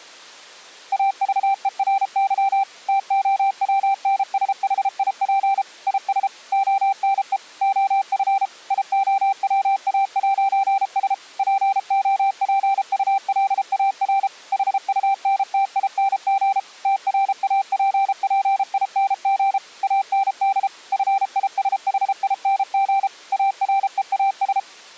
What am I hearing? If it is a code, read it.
Morse code, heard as a keyed tone, machine-sent, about 33 wpm, 780 Hz. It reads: AVERY TOWNSHIP IS ONE OF IOWA'S POPULAR HUNTING TRAPPING AND FISHING AREAS